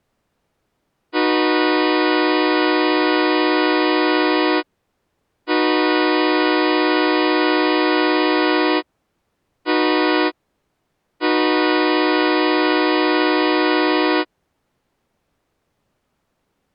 Train horn signal, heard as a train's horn. 2 long, 1 short, 1 long. On North American railways: approaching a public crossing.